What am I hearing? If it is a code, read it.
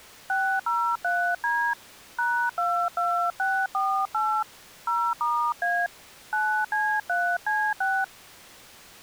DTMF, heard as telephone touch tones, dialled by hand, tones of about 280 ms. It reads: 603D #22648 0*A 9C3C6